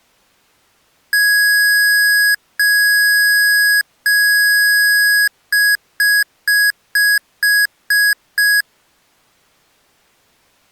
Beep code, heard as beeps from a small speaker, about 1650 Hz. 3 long, 7 short.